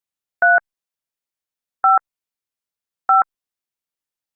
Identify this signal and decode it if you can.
DTMF, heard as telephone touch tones, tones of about 130 ms. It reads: 3 5 5